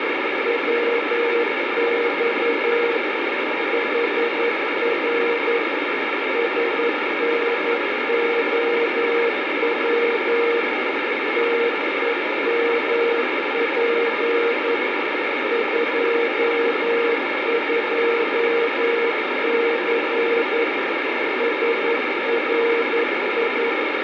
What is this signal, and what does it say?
Morse code, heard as a keyed tone, machine-sent, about 11 wpm, 470 Hz, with heavy radio static. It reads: WX HR SNOW TEMP 22C SRI